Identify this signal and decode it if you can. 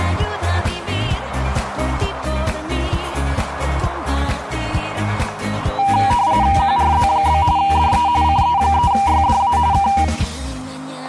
RTTY (45.45 baud, 170 Hz shift), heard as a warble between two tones, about 880 Hz centre, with static crashes. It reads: QRZ? DE CE3YDA K